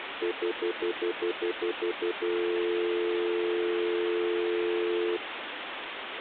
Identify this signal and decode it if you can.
Telephone call progress tone (North American plan), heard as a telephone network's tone, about 350, 440 Hz, 0.1 s on and 0.1 s off, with phone line noise. Stutter dial tone.